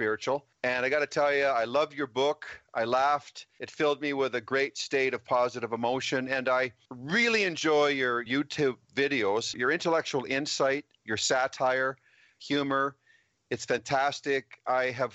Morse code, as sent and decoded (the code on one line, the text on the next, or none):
none